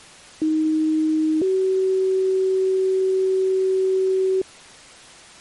Two-tone page, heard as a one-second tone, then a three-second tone, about 310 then 380 Hz.